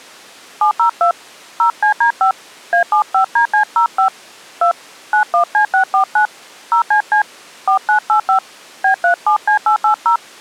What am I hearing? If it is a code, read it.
DTMF, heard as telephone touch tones, dialled by hand, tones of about 100 ms. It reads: 702 0CD5 A75DC05 2 91C649 0CC 4985 B37C880